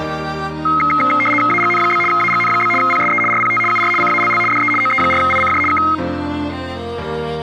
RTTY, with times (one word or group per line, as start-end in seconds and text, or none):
1.5-2.0 AGN?
2.1-2.7 AGN?
2.8-3.2 PSE
3.3-3.6 RPT
3.7-3.9 UR
4.0-4.4 CALL
4.5-4.7 DE
4.8-5.6 OE4ICJ
5.7-5.8 K